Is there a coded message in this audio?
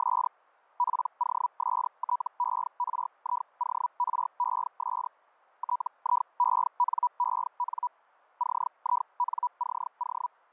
Yes: Hellschreiber (Feld-Hell, 122.5 baud) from 0.0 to 10.3 s, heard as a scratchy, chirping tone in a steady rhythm, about 980 Hz. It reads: … POSTERIORES TIENEN CINCO